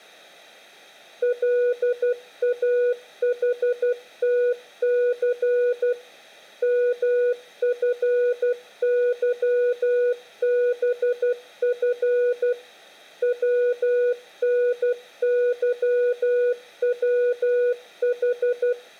Morse code, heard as a keyed tone, machine-sent, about 12 wpm, 490 Hz, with room echo. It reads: LAHTC MFYBF WNYWH